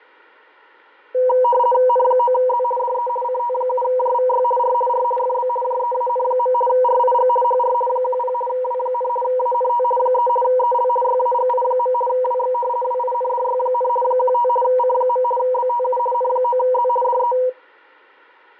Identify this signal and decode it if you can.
RTTY (50 baud, 450 Hz shift), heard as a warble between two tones, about 730 Hz centre, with fading and static crashes. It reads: N9Z DE CT7JVY R R FB JEAN. RIG HR 10 W, ANT 3 EL YAGI. WX WINDY, 15 C. BTU N9Z DE